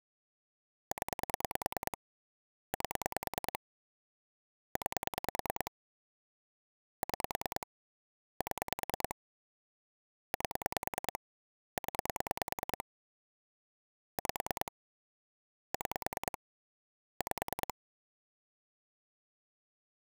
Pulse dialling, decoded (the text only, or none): 0 8 9 6 7 8 0 5 6 5